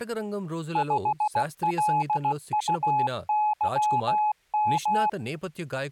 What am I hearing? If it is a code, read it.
Morse code, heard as a keyed tone, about 16 wpm, 850 Hz, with speech in Telugu. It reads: 5LUYM